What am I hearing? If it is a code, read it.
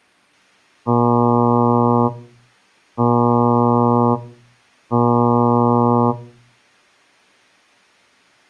Ship horn signal, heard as a ship's horn, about 120 Hz. 3 short. At sea: I am operating astern propulsion.